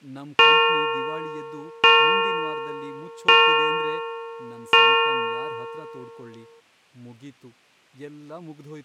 Clock strike, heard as a bell, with speech in Kannada. 4. Four o'clock.